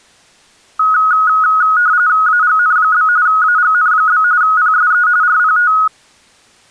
RTTY (45.45 baud, 170 Hz shift), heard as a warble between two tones, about 1360 Hz centre. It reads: AGN? AGN? PSE RPT